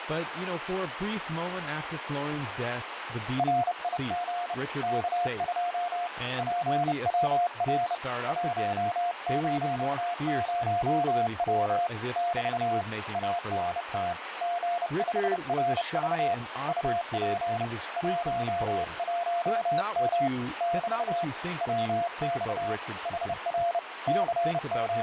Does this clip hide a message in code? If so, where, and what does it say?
Yes: Morse code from 3.3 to 25.0 s, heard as a keyed tone, hand-sent with a bug key, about 30 wpm, 700 Hz, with radio static and speech in English. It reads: RIG K2 PWR 100W <BT> ANT G5RV UP 11M <BT> WX HR …